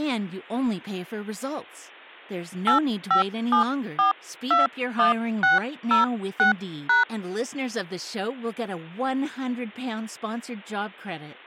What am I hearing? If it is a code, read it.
DTMF, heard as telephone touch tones, dialled by hand, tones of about 130 ms. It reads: 857421606#